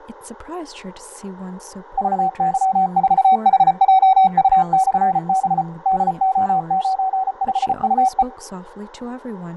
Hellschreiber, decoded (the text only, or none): none